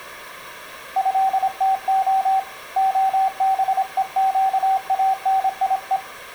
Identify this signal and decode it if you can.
Morse code (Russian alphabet), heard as a keyed tone, hand-sent with a paddle, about 26 wpm, 770 Hz, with room echo. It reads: ЭТО ОБЕЩАНИЕ